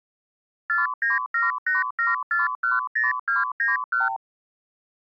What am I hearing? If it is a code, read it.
Multi-frequency trunk signalling (R2, with the far end's replies), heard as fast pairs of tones, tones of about 160 ms. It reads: 49787410291